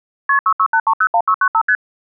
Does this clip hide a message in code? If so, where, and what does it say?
Yes: multi-frequency trunk signalling (R1, as on North American trunks) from 0.3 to 1.8 s, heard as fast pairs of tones, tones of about 70 ms. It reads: KP 668301695 ST